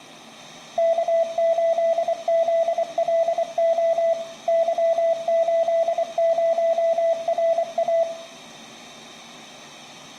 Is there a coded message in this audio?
Yes: Morse code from 0.7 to 8.1 s, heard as a keyed tone, machine-sent, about 24 wpm, 660 Hz, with room echo. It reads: K8ZLO Y80RA